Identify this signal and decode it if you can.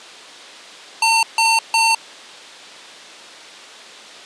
Beep code, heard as beeps from a small speaker, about 900 Hz. 3 short. In AMI BIOS tables: failure in the first 64 KB of memory; in Dell tables: chipset error.